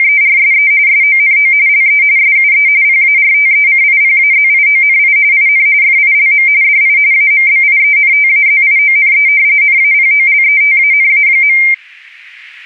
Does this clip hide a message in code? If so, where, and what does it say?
Yes: RTTY (45.45 baud, 170 Hz shift) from 0.0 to 11.7 s, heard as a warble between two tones, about 2200 Hz centre. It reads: … SONO LE SUE PARTECIPAZIONI IN FILM DI AMBIENTAZIONE NAPOLETANA.